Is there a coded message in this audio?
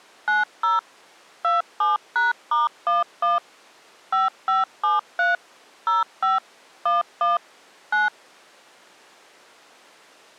Yes: DTMF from 0.3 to 8.1 s, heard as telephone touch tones, dialled by machine, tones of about 160 ms. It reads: 90 27#*11 5573 05 11 9